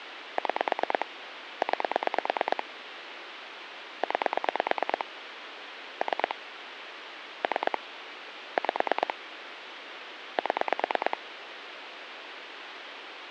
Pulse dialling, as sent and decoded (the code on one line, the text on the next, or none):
6 / 9 / 9 / 3 / 3 / 5 / 7
6 9 9 3 3 5 7